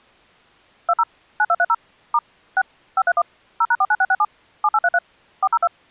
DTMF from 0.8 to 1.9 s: 20 9230

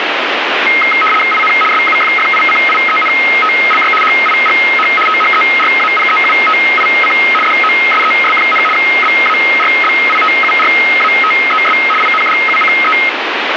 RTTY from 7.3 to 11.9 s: DOSES, BARBITURATES

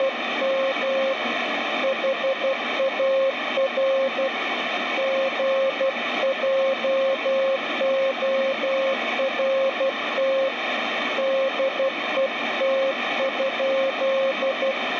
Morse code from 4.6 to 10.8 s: GJORT

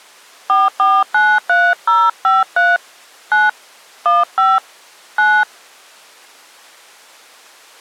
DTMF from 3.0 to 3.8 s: 9

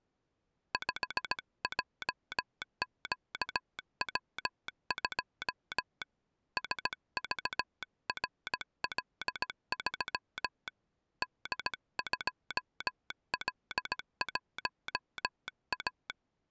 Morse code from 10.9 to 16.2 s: D2L1A

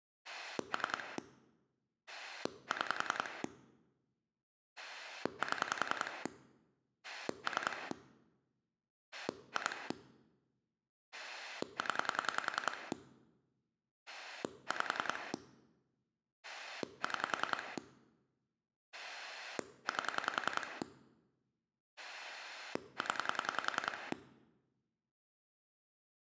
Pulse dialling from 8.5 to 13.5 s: 2 0

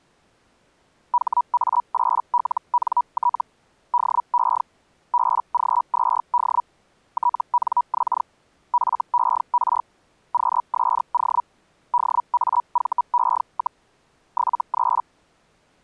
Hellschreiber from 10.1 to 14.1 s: QSO DAVE,

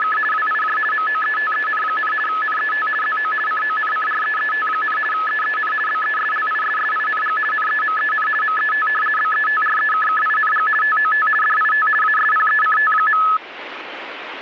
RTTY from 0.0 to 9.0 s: … WIJ MOETEN, NET ZO CONCREET, EEN BESLISSING NEMEN MET

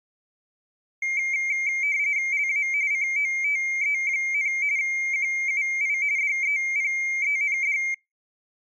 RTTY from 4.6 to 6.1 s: QUI

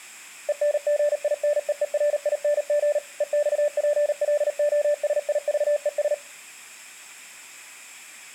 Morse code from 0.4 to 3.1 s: ENGINEERING

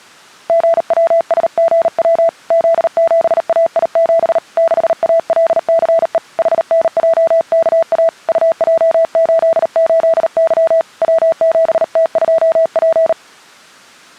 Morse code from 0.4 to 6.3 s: GWSGW Z7AI7 6ALCE

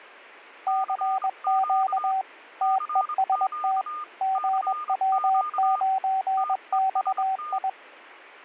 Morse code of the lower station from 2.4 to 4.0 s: TEST

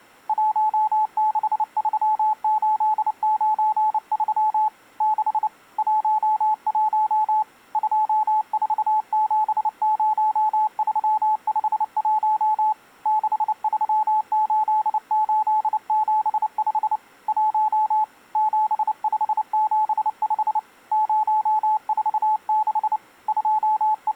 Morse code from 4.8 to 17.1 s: 6 11 2470351 638875

